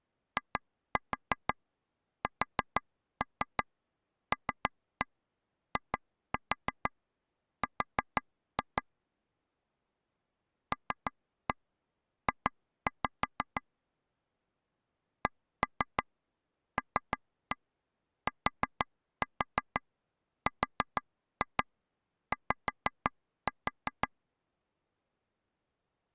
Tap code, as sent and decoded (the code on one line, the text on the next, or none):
2-4 4-3 3-1 2-4 4-2 / 3-1 2-5 / 1-3 3-1 4-4 4-2 5-4
ISLIR LJ CLTRY